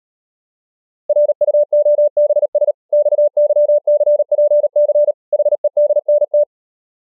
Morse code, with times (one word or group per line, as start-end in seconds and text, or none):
1.1-2.7 RUOBS
2.9-5.1 XYCPC
5.3-6.4 HEDNT